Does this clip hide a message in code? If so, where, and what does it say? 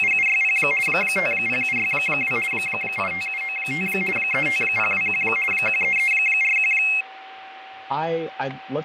Yes: RTTY (50 baud, 450 Hz shift) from 0.0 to 7.0 s, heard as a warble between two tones, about 2350 Hz centre, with radio static, fading, a steady whistle near 770 Hz and speech in English. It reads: … 50762 85795 35021 13341